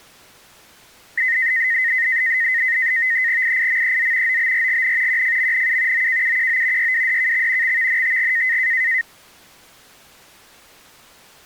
NAVTEX (SITOR-B), 100 baud, 170 Hz shift, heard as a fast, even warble, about 1950 Hz centre. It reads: IIMEZ OBRGN QFMNU OKUQO YWDKX XVNTG